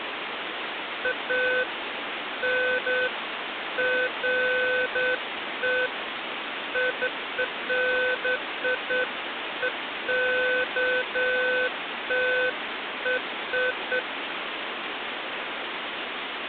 Beeps of irregular length, with phone line noise. There is no code.